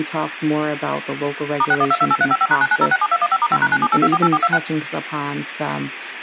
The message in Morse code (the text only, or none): none